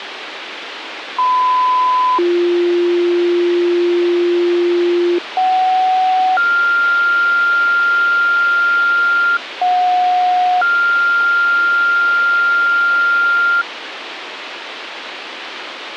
Two-tone page, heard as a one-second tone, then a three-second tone, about 1010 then 350 Hz, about 750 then 1400 Hz, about 730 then 1400 Hz, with radio hiss and a squelch burst at the end.